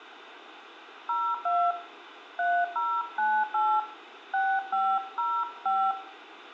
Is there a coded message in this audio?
Yes: DTMF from 1.1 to 5.9 s, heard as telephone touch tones, dialled by hand, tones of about 260 ms, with radio hiss and room echo. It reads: 02 3098 6505